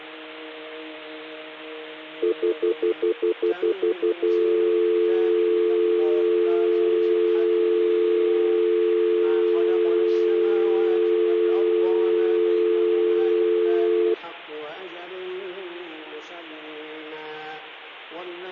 Telephone call progress tone (North American plan), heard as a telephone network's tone, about 350, 440 Hz, 0.1 s on and 0.1 s off. Stutter dial tone.